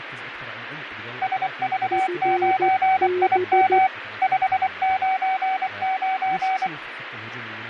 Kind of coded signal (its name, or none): Morse code